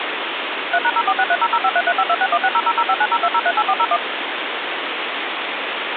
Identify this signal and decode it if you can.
DTMF, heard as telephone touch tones, dialled by machine, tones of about 60 ms, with phone line noise. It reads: 3#046300533526160005902038401